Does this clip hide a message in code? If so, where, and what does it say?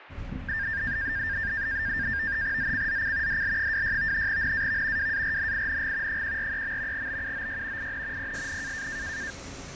Yes: NAVTEX (SITOR-B), 100 baud, 170 Hz shift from 0.5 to 9.3 s, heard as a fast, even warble, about 1700 Hz centre, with radio static, fading and the noise inside a bus. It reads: ZCZC DL26 NAV WARNING 143. BUOY IN PSN